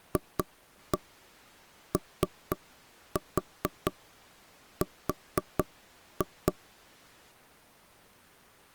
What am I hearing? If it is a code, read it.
Tap code, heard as knocks on wood, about 4 knocks a second. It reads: FOR